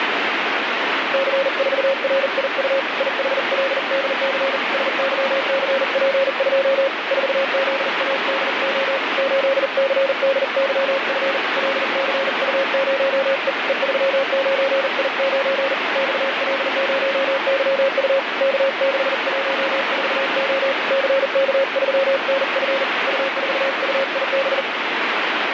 Morse code, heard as a keyed tone, hand-sent with a paddle, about 40 wpm, 540 Hz, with heavy radio static. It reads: C4RIU IHLDC SYCP2 4ZADO 8CDYF LCU0E E39I9 XL0YU K614O CK3NF U4UIB